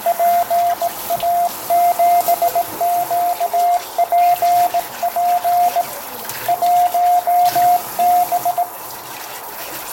Morse code, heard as a keyed tone, hand-sent with a straight key, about 18 wpm, 700 Hz, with radio static, a narrow filter, room echo and kitchen noise. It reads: PA7QPP 1B